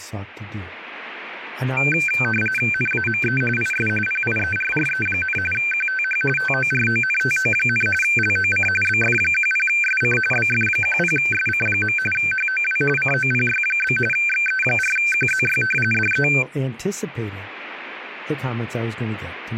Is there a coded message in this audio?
Yes: RTTY (45.45 baud, 850 Hz shift) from 1.8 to 16.4 s, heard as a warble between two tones, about 1950 Hz centre, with radio static and speech in English. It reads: NAME IS PIERRE, QTH TORONTO, LOC BF10SC BF10SC. HOW COPY? XE4QZY DE